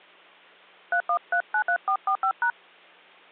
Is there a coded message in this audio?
Yes: DTMF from 0.9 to 2.5 s, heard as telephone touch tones, dialled by hand, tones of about 80 ms. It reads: 31393445#